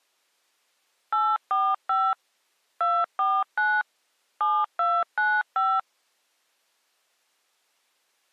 DTMF, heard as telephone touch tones, dialled by machine, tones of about 240 ms. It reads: 845 249 7295